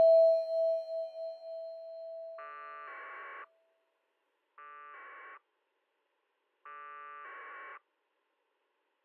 Packet radio (AX.25, as in APRS), 1200 baud, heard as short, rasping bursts.